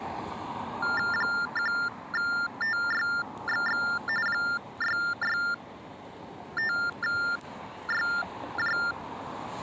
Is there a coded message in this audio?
Yes: TTY/TDD text telephone tones (45.45 baud Baudot) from 0.8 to 8.9 s, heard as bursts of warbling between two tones, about 400 Hz shift, 1600 Hz centre, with street noise. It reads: 1TYXX 665YJ